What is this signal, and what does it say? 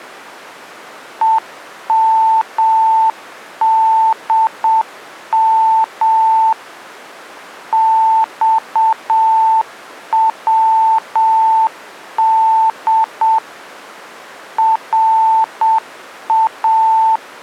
Morse code (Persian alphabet), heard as a keyed tone, machine-sent, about 7 wpm, 890 Hz. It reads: همدم خود را